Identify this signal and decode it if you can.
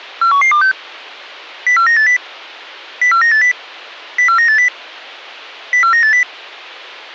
Five-tone selective call (CCIR), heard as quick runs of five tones, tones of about 100 ms. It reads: 41126 04980 04980 04980 04980